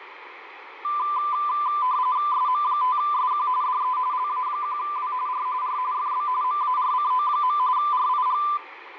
RTTY (45.45 baud, 170 Hz shift), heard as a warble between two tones, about 1100 Hz centre, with radio static. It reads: SM5SQ DE LA1W R R FB MARCO. RIG